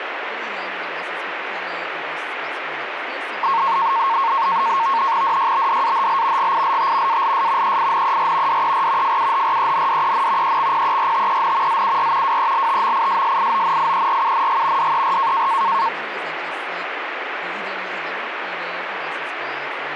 NAVTEX (SITOR-B), 100 baud, 170 Hz shift, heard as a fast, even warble, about 1000 Hz centre, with radio static and speech in English. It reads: DYBDAHL GILT ALS EINER DER FUHRENDEN EXPERTEN ZUR WELTMISSIONIERUNG DER